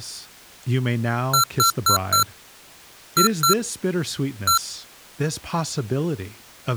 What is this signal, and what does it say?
Beep code, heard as beeps from a small speaker, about 1360 Hz, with speech in English. 4-2-1. In Phoenix BIOS tables: timer tick failure.